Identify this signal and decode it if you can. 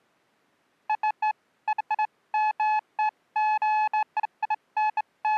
Beeps of irregular length. There is no code.